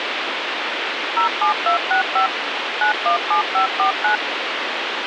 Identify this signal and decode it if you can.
DTMF, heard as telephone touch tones, dialled by machine, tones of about 110 ms, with radio hiss. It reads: 07265 917549